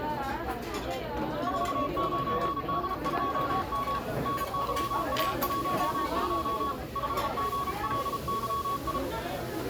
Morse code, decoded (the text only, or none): 49D2M NYA12 5GLYI